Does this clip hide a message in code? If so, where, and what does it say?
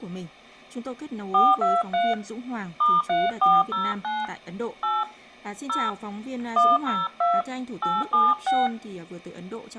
Yes: DTMF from 1.3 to 8.7 s, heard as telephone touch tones, dialled by hand, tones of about 200 ms, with speech in Vietnamese. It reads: 423 *3409 8 0 102 876